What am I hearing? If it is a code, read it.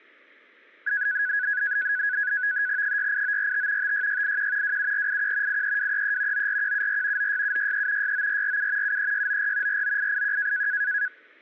NAVTEX (SITOR-B), 100 baud, 170 Hz shift, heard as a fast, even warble, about 1600 Hz centre, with static crashes. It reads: 68945 56681 27481 83233 94174 96763 69447 73694 49881